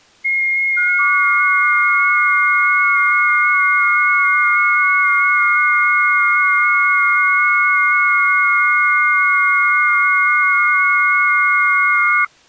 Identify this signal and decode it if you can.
FT8 (several signals at once), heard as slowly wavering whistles, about 6.25 baud.